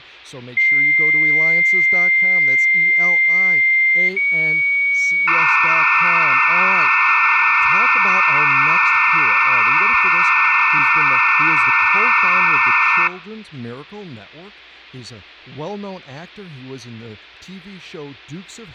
Dial-up modem handshake (low-speed, two carriers), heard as two whistles, then hiss, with speech in English.